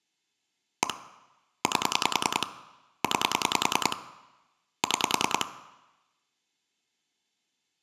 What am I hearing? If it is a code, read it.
Pulse dialling, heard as clicks on a phone line, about 10 pulses a second. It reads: 1 8 9 6